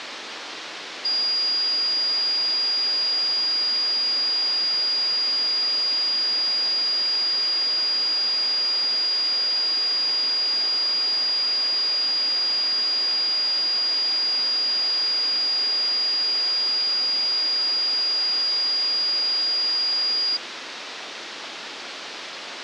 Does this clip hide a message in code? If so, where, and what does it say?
No, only a steady tone, with phone line noise.